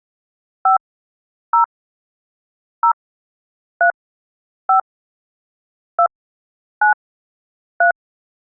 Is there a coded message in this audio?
Yes: DTMF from 0.7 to 7.9 s, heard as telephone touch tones, dialled by hand, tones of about 90 ms. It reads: 5 0 0 3 5 2 9 3